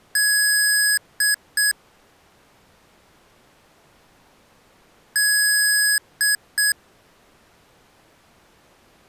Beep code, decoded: 1 long, 2 short

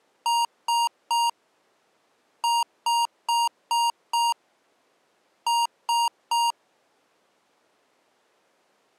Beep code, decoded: 3-5-3

